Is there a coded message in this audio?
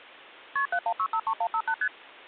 Yes: multi-frequency trunk signalling (R1, as on North American trunks) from 0.6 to 1.9 s, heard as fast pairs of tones, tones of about 70 ms. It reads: KP 71653158 ST